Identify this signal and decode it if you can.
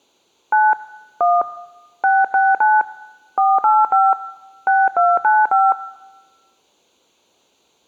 DTMF, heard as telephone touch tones, dialled by hand, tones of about 210 ms. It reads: 9 1 669 485 6295